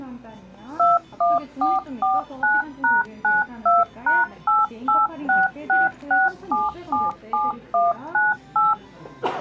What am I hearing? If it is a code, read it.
DTMF, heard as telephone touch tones, dialled by machine, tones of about 180 ms, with the noise of a cafe. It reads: 21449#92#88666777198